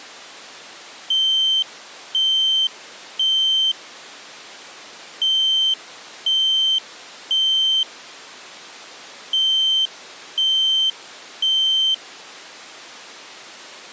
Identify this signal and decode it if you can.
Alarm pattern, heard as an alarm's beeps, played three times, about 3100 Hz. Temporal three. Smoke or fire, evacuate.